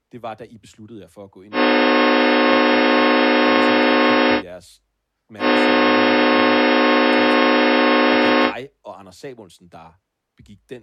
Train horn signal, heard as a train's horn, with speech in Danish. 2 long. On North American railways: brakes released, proceed.